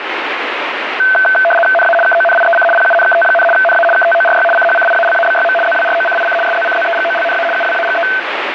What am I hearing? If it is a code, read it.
RTTY (75 baud, 850 Hz shift), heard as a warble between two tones, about 1100 Hz centre, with radio static. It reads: NA KONIEC PUNKT, NA KTORY CHCIALABYM ZWROCIC SZCZEGOLNA UWAGE